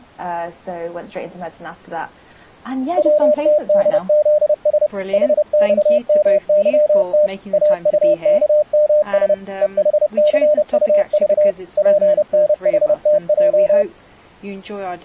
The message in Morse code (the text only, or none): WTDZS HXMYT AUKMS EHCUV PNHTJ